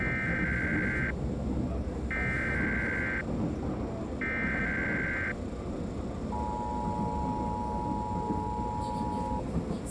Emergency Alert System (SAME) tones (header bursts, then the 853 and 960 Hz attention tone), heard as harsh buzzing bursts, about 520.83 baud, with the noise inside a subway train.